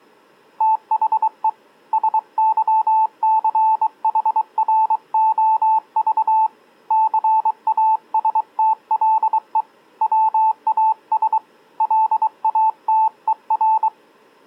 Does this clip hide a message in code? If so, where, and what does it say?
Yes: Morse code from 0.5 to 13.9 s, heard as a keyed tone, hand-sent with a bug key, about 23 wpm, 880 Hz. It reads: THE SYCHROV CASTLE WAS LATER